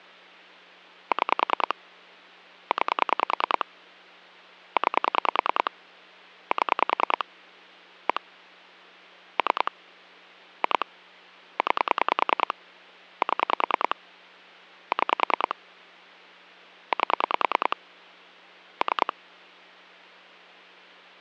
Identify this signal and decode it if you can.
Pulse dialling, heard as clicks on a phone line, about 10 pulses a second, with hum. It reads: 6 9 9 7 1 3 2 9 7 6 8 3